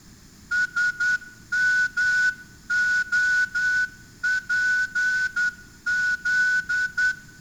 Morse code, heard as a whistle, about 10 wpm, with room echo. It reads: SMOPZ